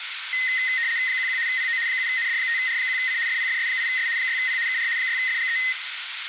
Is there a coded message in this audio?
Yes: RTTY (75 baud, 170 Hz shift) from 0.3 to 5.7 s, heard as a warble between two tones, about 1950 Hz centre, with radio static, a narrow filter and room echo. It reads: 11 PO 7ND5R1C FPFS8S 6P KR 6FGE